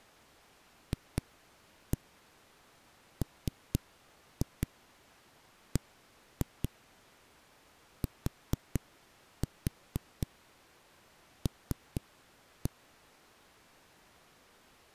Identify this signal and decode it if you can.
Tap code, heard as knocks on a wall, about 4 knocks a second. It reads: FMBTL